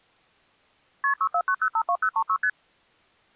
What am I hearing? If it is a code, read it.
Multi-frequency trunk signalling (R1, as on North American trunks), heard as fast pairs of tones, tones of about 70 ms. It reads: KP 649052036 ST